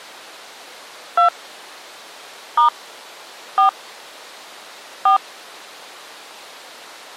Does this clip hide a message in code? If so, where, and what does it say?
Yes: DTMF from 1.2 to 5.2 s, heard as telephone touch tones, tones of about 110 ms. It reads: 2 * 4 4